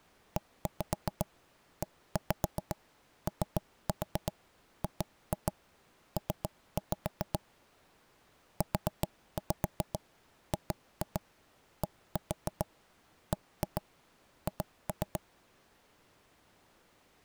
Tap code, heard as knocks on wood, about 7 knocks a second. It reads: EEOGP UGDBH